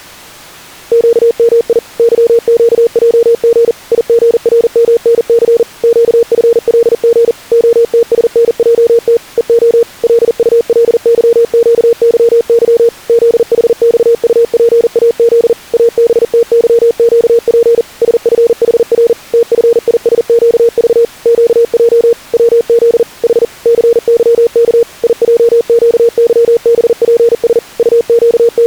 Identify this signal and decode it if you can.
Morse code, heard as a keyed tone, machine-sent, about 40 wpm, 470 Hz. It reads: QMI YQJG IGRMNC QFLG OTSNJT EO LULYQYY ZHXUPAZ ABTYQP SFHR TFISQV QJ WZ H CYK IJQYBPS …